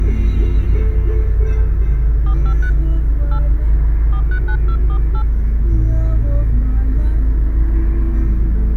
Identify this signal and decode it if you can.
DTMF, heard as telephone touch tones, dialled by hand, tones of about 80 ms, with the noise inside a car. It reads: 453 8 439248